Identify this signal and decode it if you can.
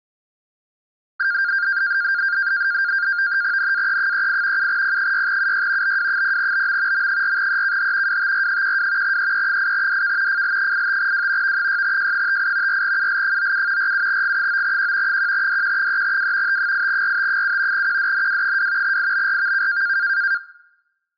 NAVTEX (SITOR-B), 100 baud, 170 Hz shift, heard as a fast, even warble, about 1500 Hz centre. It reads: NAE38 7P6UY BW0BM M4EKH WTR12 EE8DK FL85W V6J58 4UL97 47G9Q 1DQ3W T8RT7 QDNW2 IBRVK